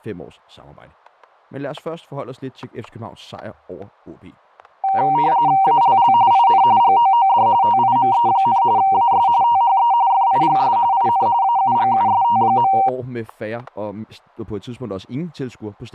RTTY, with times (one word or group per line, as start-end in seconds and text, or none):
5.6-6.1 ALL
6.3-6.6 IN
6.8-7.5 GOOD
7.6-8.6 TIME,
8.8-9.3 AS
9.4-9.9 THE
10.1-10.8 FIGS
10.9-11.3 IN
11.4-12.7 AUGUST.